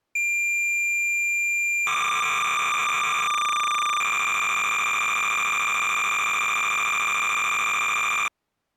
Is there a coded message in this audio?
Yes: cassette data (Kansas City type), 300 baud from 0.2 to 8.3 s, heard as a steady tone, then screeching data.